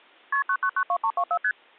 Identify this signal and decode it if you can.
Multi-frequency trunk signalling (R1, as on North American trunks), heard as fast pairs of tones, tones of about 70 ms. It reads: KP 9992324 ST